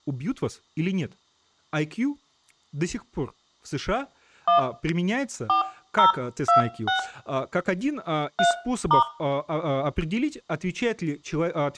DTMF, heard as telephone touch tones, dialled by hand, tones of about 120 ms, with room echo and speech in Russian. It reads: 1 4026 3*